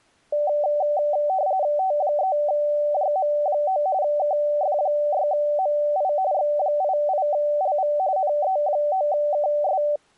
RTTY (45.45 baud, 170 Hz shift), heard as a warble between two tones, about 680 Hz centre. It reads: T3JM9 KF6MI X88LV NE9KS